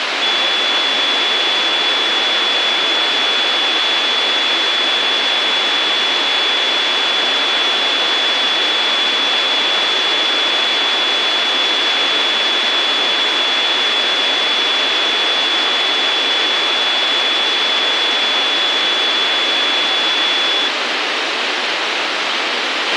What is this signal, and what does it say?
A steady tone, with radio hiss and a squelch burst at the end. There is no code.